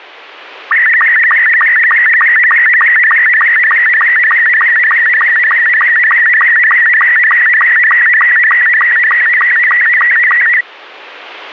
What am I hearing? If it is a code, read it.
SSTV (slow-scan television), Robot 72, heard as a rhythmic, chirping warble.